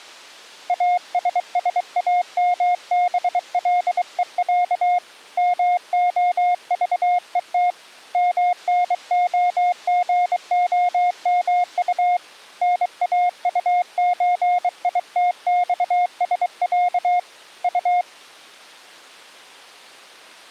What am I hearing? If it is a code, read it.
Morse code (Russian alphabet), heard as a keyed tone, hand-sent with a bug key, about 23 wpm, 710 Hz. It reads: АССАМБЛЕЯ МОЖЕТ МНОГОМУ НАУЧИТЬСЯ У